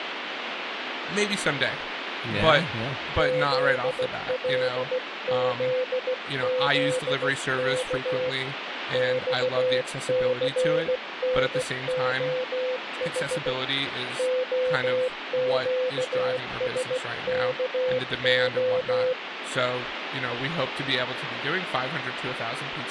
Morse code, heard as a keyed tone, hand-sent with a paddle, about 16 wpm, 510 Hz, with radio static and speech in English. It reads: ZLZZK XCNOH OQSKO